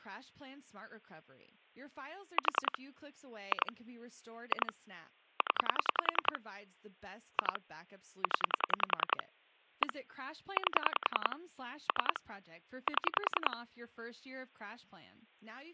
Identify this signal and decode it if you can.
Pulse dialling, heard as clicks on a phone line, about 10 pulses a second, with speech in English. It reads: 4 2 2 0 2 0 1 8 3 7